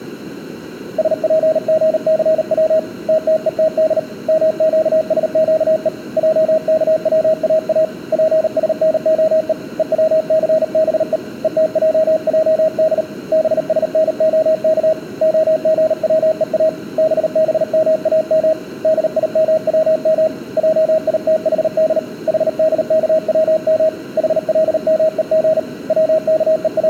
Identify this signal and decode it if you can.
Morse code (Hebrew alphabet), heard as a keyed tone, hand-sent with a paddle, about 38 wpm, 630 Hz, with room echo. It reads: שפגסץ תתותד מקשקו עכצאא פשנהו וצסבו ותעעד בשנהך הגצוא בבמאם דימצם עיתחד חדכצם חלמוג …